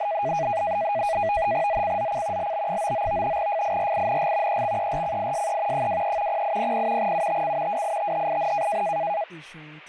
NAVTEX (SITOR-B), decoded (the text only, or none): ZCZC LB99 FIRING EXERCISE 23 0800 UTC WITHIN